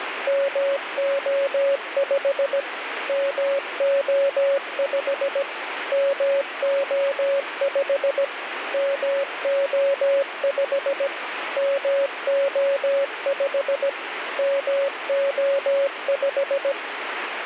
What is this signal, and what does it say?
Morse code, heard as a keyed tone, machine-sent, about 17 wpm, 560 Hz, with radio static. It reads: MO5 MO5 MO5 MO5 MO5 MO5